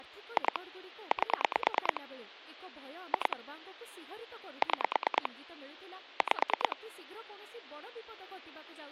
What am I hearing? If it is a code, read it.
Pulse dialling, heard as clicks on a phone line, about 9 pulses a second, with speech in Odia. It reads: 2 8 2 6 5